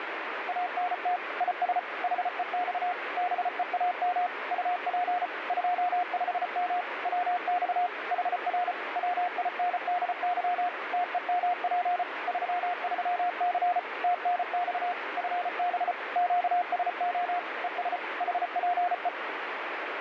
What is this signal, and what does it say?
Morse code, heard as a keyed tone, machine-sent, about 34 wpm, 710 Hz, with radio static. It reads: ANT IS HEX BEAM UP 25M WX HR WINDY TEMP 33C TNX FB QSO ES HPE